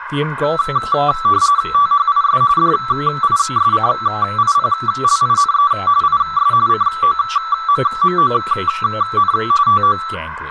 RTTY (45.45 baud, 170 Hz shift), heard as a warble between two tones, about 1240 Hz centre, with radio static and speech in English. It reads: THIS DISCIPLINE IS COMMON TO